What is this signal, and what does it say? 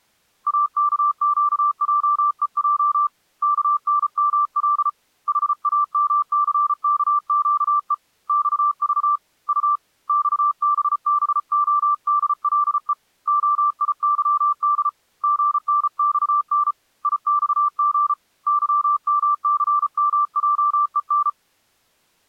Morse code, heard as a keyed tone, hand-sent with a paddle, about 34 wpm, 1170 Hz. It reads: AKQJEJ KNML HAMCKQE XV U XBBODLE OIYD GNXN IXG YMCMJEN